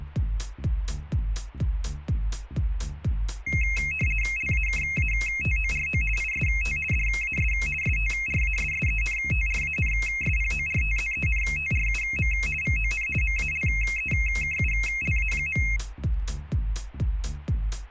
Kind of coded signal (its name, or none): RTTY